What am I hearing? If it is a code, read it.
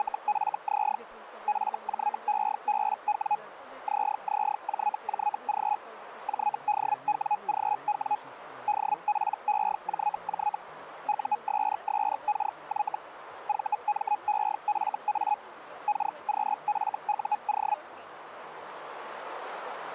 Hellschreiber (Feld-Hell, 122.5 baud), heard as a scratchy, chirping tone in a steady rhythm, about 840 Hz, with radio static. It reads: … FJEBW ZZJJG JDWGW DPEJJ USSKY VMEFA KQFUO